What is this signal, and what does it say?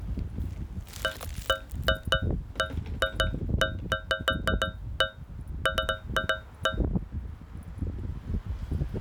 Irregular taps on a metal pipe, with the noise of a residential street. There is no code.